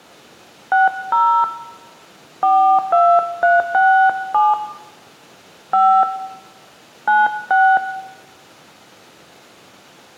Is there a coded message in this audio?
Yes: DTMF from 0.7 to 7.8 s, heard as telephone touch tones, dialled by hand, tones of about 250 ms, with room echo. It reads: 60 42367 5 96